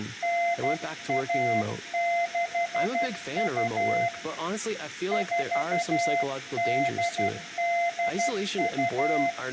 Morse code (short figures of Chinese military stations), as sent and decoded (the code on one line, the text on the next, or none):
-. .- -.... ..- / ....- -.. -.. ..-
9162 4882